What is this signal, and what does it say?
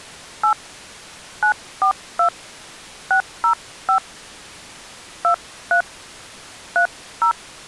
DTMF, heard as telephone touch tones, dialled by hand, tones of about 100 ms. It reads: 8 942 605 23 30